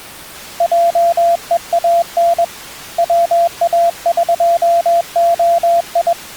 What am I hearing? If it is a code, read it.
Morse code (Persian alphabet), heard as a keyed tone, hand-sent with a bug key, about 21 wpm, 680 Hz. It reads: جهان واقعی